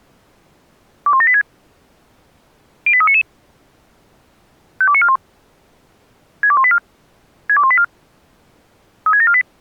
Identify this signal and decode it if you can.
Five-tone selective call (ZVEI), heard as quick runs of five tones, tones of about 70 ms. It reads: 21786 08399 52941 62184 62184 36748